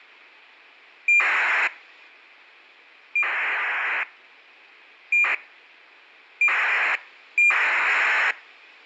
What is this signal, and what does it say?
ACARS aircraft data, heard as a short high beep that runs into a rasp, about 2400 baud.